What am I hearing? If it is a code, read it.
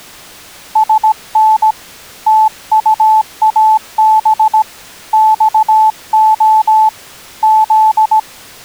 Morse code, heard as a keyed tone, hand-sent with a paddle, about 17 wpm, 870 Hz. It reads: SN TUAB XO Z